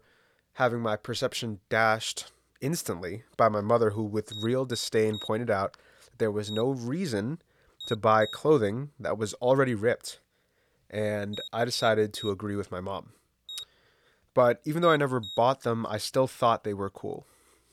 Beep code, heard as a piezo beeper, played twice, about 3750 Hz, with speech in English. 3-1-2. In Phoenix BIOS tables: DMA register failure.